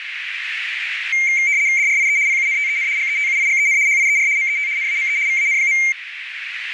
RTTY (75 baud, 170 Hz shift), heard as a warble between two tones, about 2200 Hz centre, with radio static and a narrow filter. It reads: DRIE PUNTEN GETUIGEN HIER MET NAME VAN.